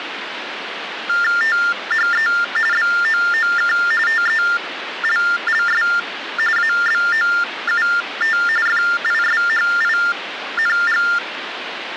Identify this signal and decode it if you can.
TTY/TDD text telephone tones (45.45 baud Baudot), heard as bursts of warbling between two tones, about 400 Hz shift, 1600 Hz centre, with phone line noise. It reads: THE BOOK TELLS ABOUT FISHING